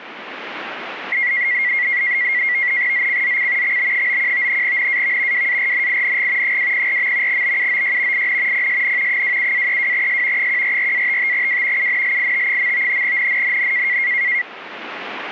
NAVTEX (SITOR-B), 100 baud, 170 Hz shift, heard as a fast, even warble, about 2050 Hz centre. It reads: ZCZC XB91 NAV WARNING 204. BUOY IN PSN 27-32S 144-55W UNLIT. NNNN